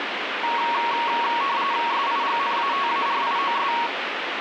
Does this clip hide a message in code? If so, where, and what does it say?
Yes: RTTY (45.45 baud, 170 Hz shift) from 0.4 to 3.9 s, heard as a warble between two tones, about 1020 Hz centre, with radio static. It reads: SIGNATARIOS